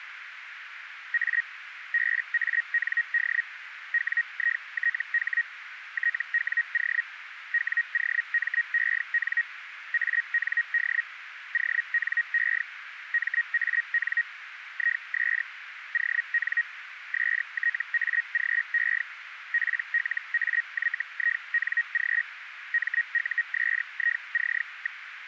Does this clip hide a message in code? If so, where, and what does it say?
Yes: Hellschreiber (Feld-Hell, 122.5 baud) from 1.1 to 25.0 s, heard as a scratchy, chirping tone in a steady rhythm, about 1900 Hz, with radio static and a narrow filter. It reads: A BAND WITH TWO WOMEN AND ONE MAN IS ON STAGE PLAYING MUSIC.